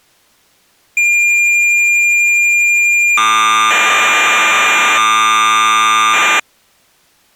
Cassette data (Kansas City type), 1200 baud, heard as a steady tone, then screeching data.